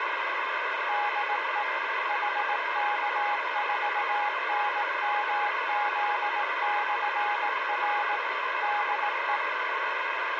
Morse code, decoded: DE HK4NMZ/R DE

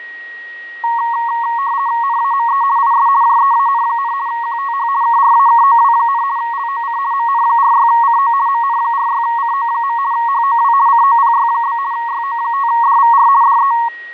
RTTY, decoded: NAME IS JEAN, QTH KRAKOW, LOC MN46CO MN46CO. HOW COPY? YO5DVR DE

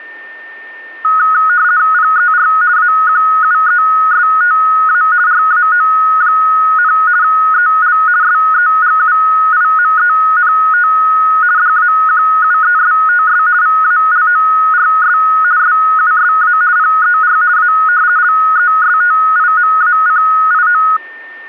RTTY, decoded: PER AQUESTA RAO, EL SEGUIMENT DAQUESTS VALORS SUSA PER A LESTIMACIO

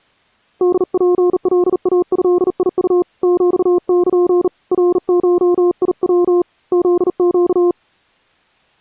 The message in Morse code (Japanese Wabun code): ホツカイドウ ヒル ナゴヤ フネ

